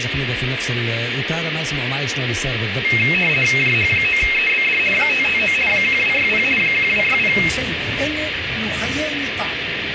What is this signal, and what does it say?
RTTY (50 baud, 450 Hz shift), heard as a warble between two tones, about 2350 Hz centre, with radio static and room echo. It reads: JH9EBD 559 1260 1260